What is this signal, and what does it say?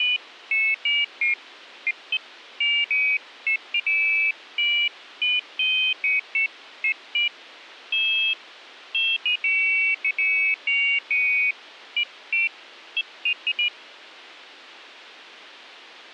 Pairs of high tones at irregular times. There is no code.